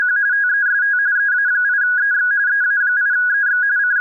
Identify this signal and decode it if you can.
RTTY (45.45 baud, 170 Hz shift), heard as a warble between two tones, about 1550 Hz centre. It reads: … TEST EA8EX EA8EX …